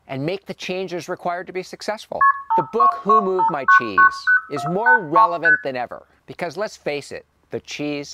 Multi-frequency trunk signalling (R1, as on North American trunks), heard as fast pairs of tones, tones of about 100 ms, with room echo and speech in English. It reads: KP 5225990483 ST